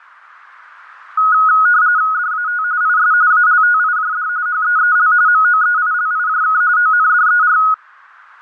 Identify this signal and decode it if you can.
RTTY (45.45 baud, 170 Hz shift), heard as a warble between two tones, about 1360 Hz centre. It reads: DAT IS ALTIJD HEEL MOEILIJK ONDER